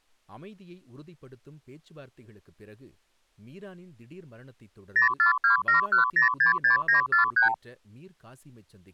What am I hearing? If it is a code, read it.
Multi-frequency trunk signalling (R2, with the far end's replies), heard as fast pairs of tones, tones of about 120 ms, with speech in Tamil. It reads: 04271066943